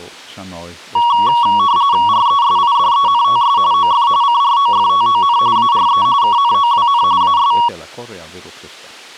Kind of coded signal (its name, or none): RTTY